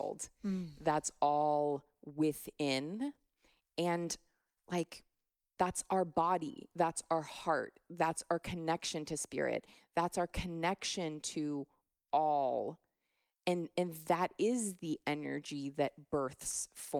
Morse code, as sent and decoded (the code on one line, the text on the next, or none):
none